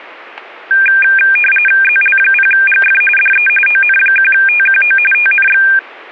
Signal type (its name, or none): RTTY